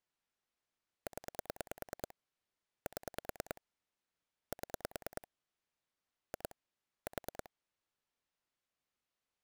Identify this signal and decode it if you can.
Pulse dialling, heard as clicks on a phone line, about 9 pulses a second. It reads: 0 7 7 2 4